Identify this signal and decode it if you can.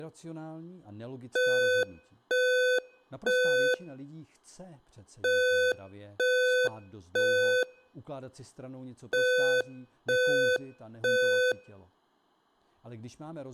Alarm pattern, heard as an alarm's beeps, played three times, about 500 Hz, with room echo and speech in Czech. Temporal three. Smoke or fire, evacuate.